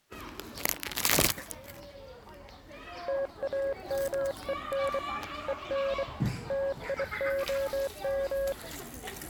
Morse code, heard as a keyed tone, hand-sent with a bug key, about 24 wpm, 550 Hz, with the noise of a park. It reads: TAMEN EN TIOM